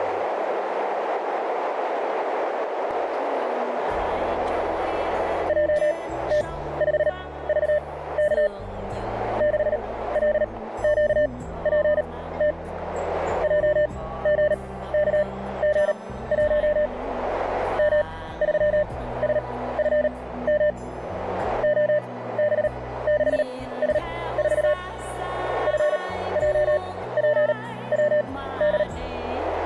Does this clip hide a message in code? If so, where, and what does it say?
Yes: Morse code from 5.4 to 28.9 s, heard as a keyed tone, machine-sent, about 38 wpm, spaced as for 17 wpm, 600 Hz, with radio static and a narrow filter. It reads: JT5VK 6LQPT JGKG1 M3SFM OB6S4 FJPWD